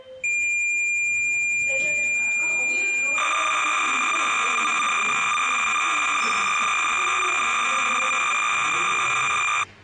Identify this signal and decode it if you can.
Cassette data (Kansas City type), 300 baud, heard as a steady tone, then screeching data, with the noise inside a lift.